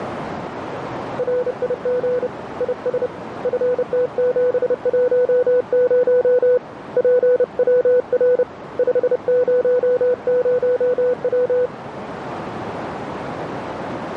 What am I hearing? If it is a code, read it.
Morse code, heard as a keyed tone, hand-sent with a bug key, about 30 wpm, 500 Hz, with radio static and a narrow filter. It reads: RIG IS FT710 PWR 500W